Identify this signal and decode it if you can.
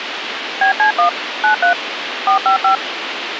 DTMF, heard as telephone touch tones, dialled by machine, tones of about 110 ms, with radio hiss. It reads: BC1 93 455